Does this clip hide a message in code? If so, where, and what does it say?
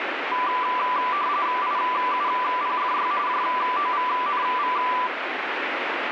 Yes: RTTY (45.45 baud, 170 Hz shift) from 0.3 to 5.1 s, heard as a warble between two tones, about 1080 Hz centre, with radio static. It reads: IUPFY JOVNV